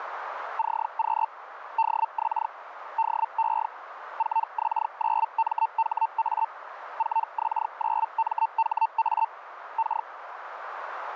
Hellschreiber (Feld-Hell, 122.5 baud), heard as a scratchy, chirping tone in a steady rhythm, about 900 Hz, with radio static and a narrow filter. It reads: CQ DX DE 4X9MHA 4X9MHA K